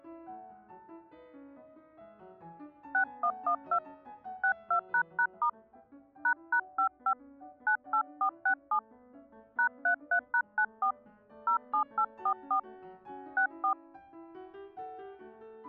DTMF, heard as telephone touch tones, dialled by hand, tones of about 90 ms. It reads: 6112 62##* ##55 98467 #33#94 07844 64